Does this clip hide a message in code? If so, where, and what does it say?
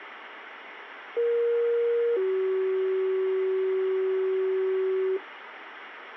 Yes: two-tone page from 1.2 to 5.2 s, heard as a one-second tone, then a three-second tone, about 470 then 380 Hz, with radio hiss.